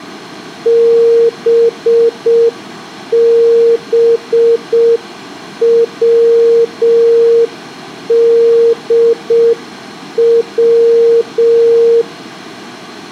Morse code, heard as a keyed tone, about 6 wpm, 460 Hz, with room echo. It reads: BBWDW